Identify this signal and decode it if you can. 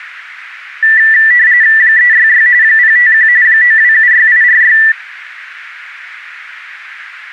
RTTY (45.45 baud, 170 Hz shift), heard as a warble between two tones, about 1850 Hz centre. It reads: 366 051 9276846